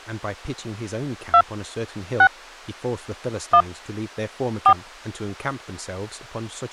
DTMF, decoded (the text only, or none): 2 6 1 4